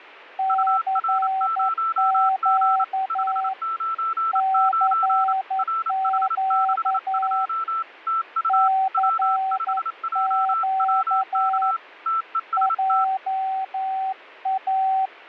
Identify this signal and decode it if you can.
Morse code, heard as two keyed tones. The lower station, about 11 wpm, 770 Hz: CQ CQ CQ JA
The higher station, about 28 wpm, 1330 Hz: UR0G 599 RH62 TU W5JWK TEST